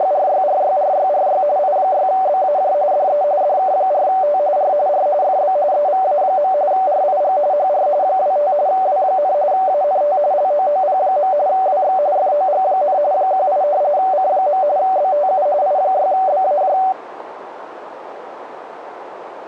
RTTY (45.45 baud, 170 Hz shift), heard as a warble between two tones, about 670 Hz centre, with radio static and a narrow filter. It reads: … I6BAJ DE DK4T R R FB EVA. RIG HR 25 W, ANT LOOP. WX FOG, 18 C. BTU I6BAJ